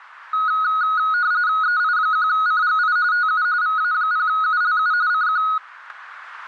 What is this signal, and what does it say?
RTTY (45.45 baud, 170 Hz shift), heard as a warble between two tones, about 1360 Hz centre. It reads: EI1CGI TU VA0ULU CQ